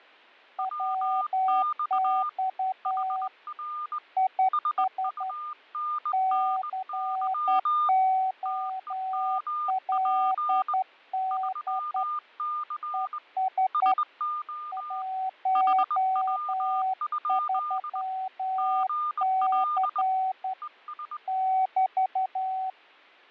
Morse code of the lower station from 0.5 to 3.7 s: WX

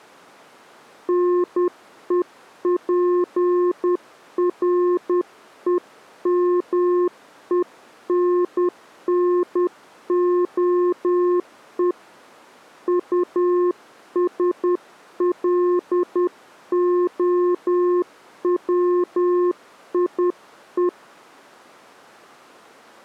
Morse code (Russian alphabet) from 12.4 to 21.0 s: УСЛОВИЕ

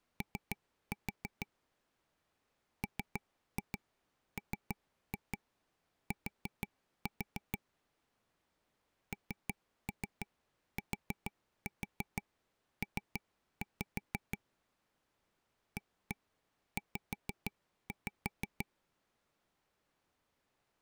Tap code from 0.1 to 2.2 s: O

